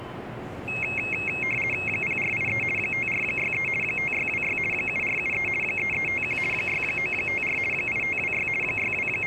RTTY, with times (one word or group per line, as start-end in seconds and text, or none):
1.9-2.6 0483
2.8-3.7 5463
3.8-4.6 5626
4.7-5.5 7473
5.6-6.4 3351
6.5-7.6 6954
7.7-8.5 8526
8.6-9.3 …